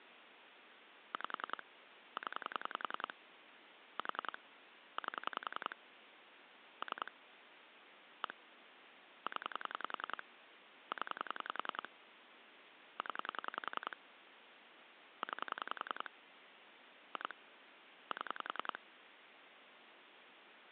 Pulse dialling, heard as clicks on a phone line, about 10 pulses a second, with phone line noise. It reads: 5 0 4 8 3 1 0 0 0 9 2 7